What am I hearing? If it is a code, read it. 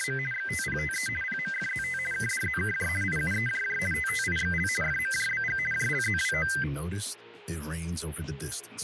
RTTY (50 baud, 450 Hz shift), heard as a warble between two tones, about 1800 Hz centre. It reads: … XTPTE PMFZT KDZKJ IUEJJ TTIXL FMJBG JLZWO